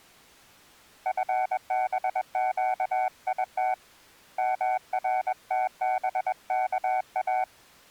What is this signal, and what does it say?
Morse code (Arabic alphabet), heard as a keyed tone, hand-sent with a paddle, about 21 wpm, 750 Hz. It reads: فبقيت مرتبكا